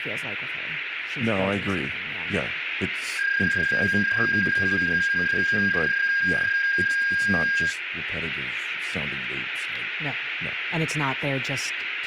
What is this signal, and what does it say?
PSK31 (31.25 baud), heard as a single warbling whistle, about 1600 Hz, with radio static, room echo and speech in English.